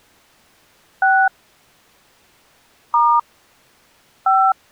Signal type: DTMF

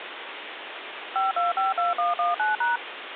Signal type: DTMF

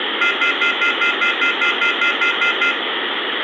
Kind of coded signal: telephone call progress tone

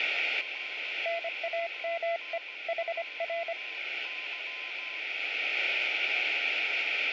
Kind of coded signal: Morse code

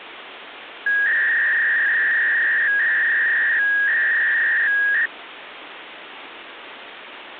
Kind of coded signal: 300-baud modem data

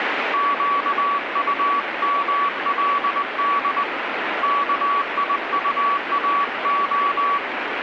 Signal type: Morse code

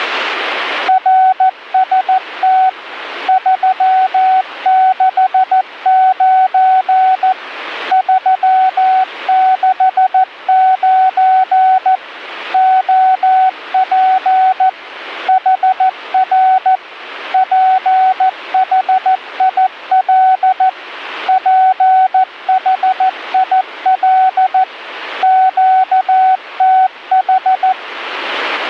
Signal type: Morse code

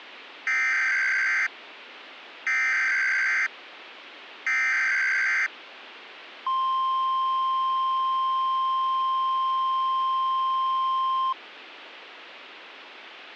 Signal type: Emergency Alert System (SAME) tones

